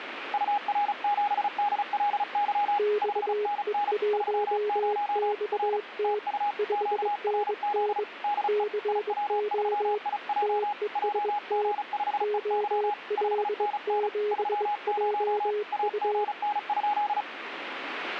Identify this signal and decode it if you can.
Morse code, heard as two keyed tones, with radio static. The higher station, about 35 wpm, 830 Hz: UR7DLY 5NN 30 R TU QRZ DE IW3IJ JG5EY 5NN 30 AGN?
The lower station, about 22 wpm, 420 Hz: XE1XT 5NN CO TEST OL7JU